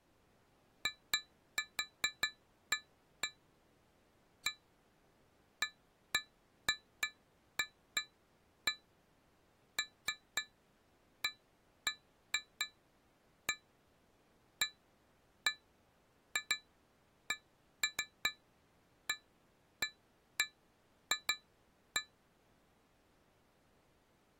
Irregular taps on glass. There is no code.